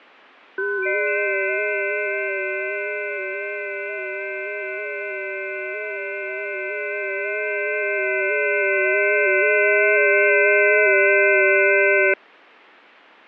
FT8 (several signals at once), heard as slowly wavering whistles, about 6.25 baud, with radio static and fading.